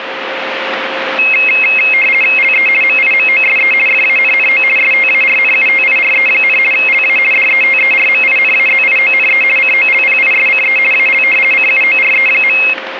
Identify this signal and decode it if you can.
RTTY (50 baud, 450 Hz shift), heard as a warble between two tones, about 2350 Hz centre, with radio static and a steady whistle near 530 Hz. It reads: LE MIMOSE FANNO STARNUTIRE, LA DETERMINAZIONE COLPISCE AL CUORE.